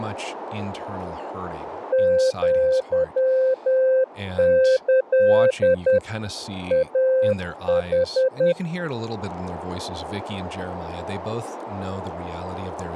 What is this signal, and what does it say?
Morse code (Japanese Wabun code), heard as a keyed tone, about 10 wpm, 520 Hz, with speech in English. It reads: アキ イヌ